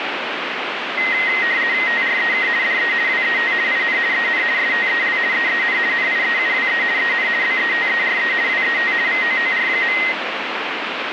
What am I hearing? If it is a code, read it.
RTTY (50 baud, 170 Hz shift), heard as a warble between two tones, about 1950 Hz centre, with radio static. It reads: TREK DE WET IN EN STEL EEN NIEUWE EN BETERE WET VOOR.